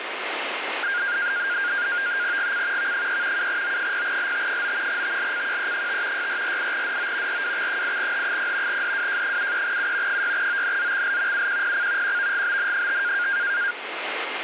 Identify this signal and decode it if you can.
NAVTEX (SITOR-B), 100 baud, 170 Hz shift, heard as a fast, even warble, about 1500 Hz centre, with radio static. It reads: GC V3 7O0LT9 TLCQE5 6448DO RWX8H0 DWJ73U 6ONZXL UQPC QVGBN5